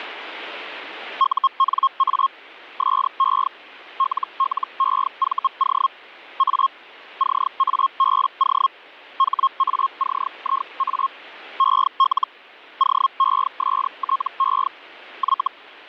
Hellschreiber (Feld-Hell, 122.5 baud), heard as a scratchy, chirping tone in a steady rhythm, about 1080 Hz. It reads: UNA SE LLEVO A CABO HACIA EL OESTE Y